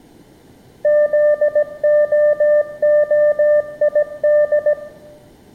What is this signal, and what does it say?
Morse code (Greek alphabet), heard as a keyed tone, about 17 wpm, 600 Hz, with room echo. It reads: ΖΟΟΙΔ